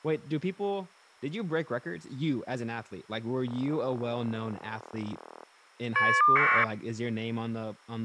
Caller ID data burst, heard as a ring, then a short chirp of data, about 1200 baud, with speech in English.